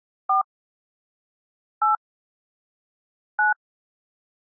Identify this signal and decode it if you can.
DTMF, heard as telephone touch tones, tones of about 130 ms. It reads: 4 8 9